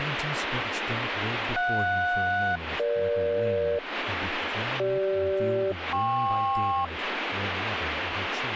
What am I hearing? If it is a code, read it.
Aircraft SELCAL, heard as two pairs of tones, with radio static and speech in English. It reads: JS-EG CG-KP